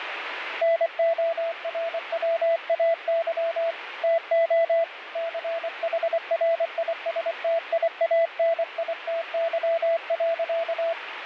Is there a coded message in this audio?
Yes: Morse code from 0.6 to 11.0 s, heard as a keyed tone, hand-sent with a paddle, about 24 wpm, 670 Hz, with radio static. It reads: NORWAY TO CHRISTIANITY.